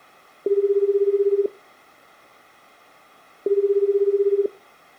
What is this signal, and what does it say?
Telephone call progress tone (Japanese plan), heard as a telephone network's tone, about 380, 400, 420 Hz, 1 s on and 2 s off, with room echo. Ringback tone.